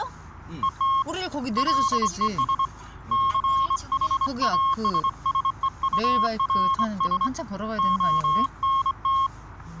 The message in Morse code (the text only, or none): ET LES CHASSEURS ONT